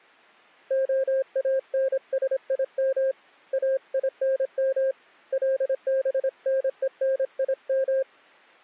Morse code (Hebrew alphabet), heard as a keyed tone, hand-sent with a paddle, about 26 wpm, 530 Hz. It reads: האנשים אינם לבנונים